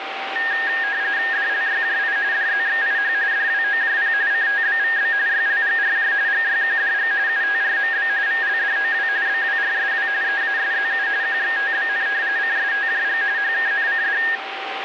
RTTY (45.45 baud, 170 Hz shift), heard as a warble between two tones, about 1750 Hz centre, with radio static and a steady whistle near 780 Hz. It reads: DLYJI DZXIH DWOJP CTBVB YLGRJ GYQDG UTRMB VLDOW BWRSW EASZU QXTBN CSTJG HKNCD